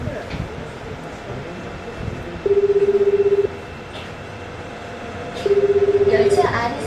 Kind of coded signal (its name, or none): telephone call progress tone